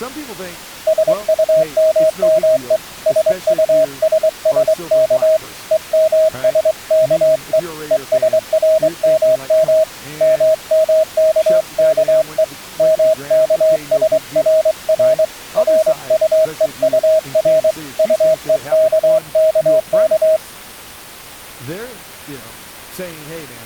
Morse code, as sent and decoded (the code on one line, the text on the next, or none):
... ..- -- -- . / ... ..- ... ... -.- / . -- ... -.- . / . ... .-. -- -- / -- -- -.- -.- . / -- -.- ... .-. .-. / .-. ..- . ..- .-. / ..- . -.- -.- -.-
SUMME SUSSK EMSKE ESRMM MMKKE MKSRR RUEUR UEKKK